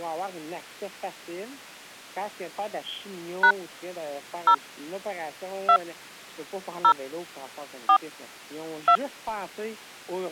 DTMF, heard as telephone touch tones, dialled by hand, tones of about 80 ms. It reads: # 0 2 0 4 2